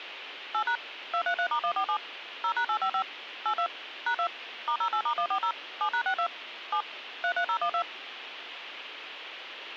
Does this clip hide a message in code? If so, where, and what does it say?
Yes: DTMF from 0.5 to 7.8 s, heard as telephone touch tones, dialled by machine, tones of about 80 ms, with phone line noise. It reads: 8# 233*147 0#855 82 #2 *08*140 7#62 7 33012